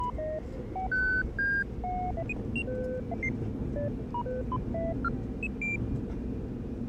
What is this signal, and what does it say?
Electronic bleeps of random pitch and length, with the noise inside a subway train. There is no code.